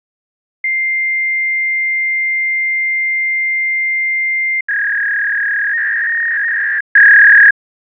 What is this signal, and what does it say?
Fax machine handshake, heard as a long tone and a warble.